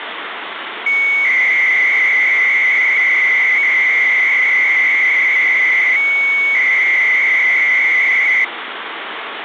300-baud modem data (Bell 103 tones), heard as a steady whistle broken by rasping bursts, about 300 baud, 200 Hz shift, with phone line noise.